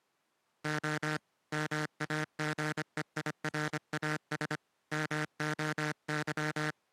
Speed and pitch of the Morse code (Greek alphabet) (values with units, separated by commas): 25 wpm